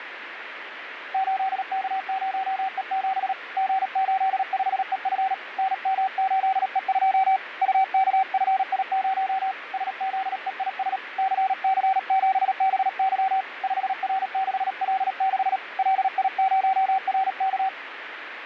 Morse code, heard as a keyed tone, hand-sent with a paddle, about 37 wpm, 770 Hz, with radio static and fading. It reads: 8K0E7 G85EF NM8E2 UKFI0 SZEIS CC7BY 5R6L6 LI0RK